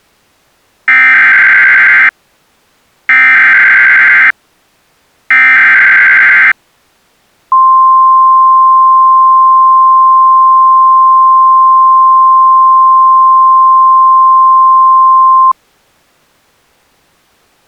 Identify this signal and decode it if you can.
Emergency Alert System (SAME) tones (header bursts, then the 1050 Hz attention tone), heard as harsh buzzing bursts, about 520.83 baud.